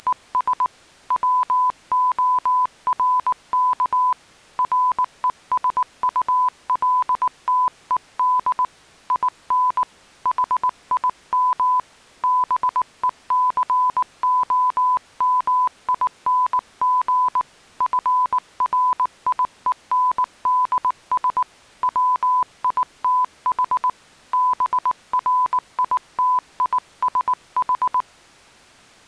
Morse code, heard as a keyed tone, hand-sent with a paddle, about 19 wpm, 1000 Hz. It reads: … WORK RESULTED IN HIM BECOMING FRIENDS WITH BRITISH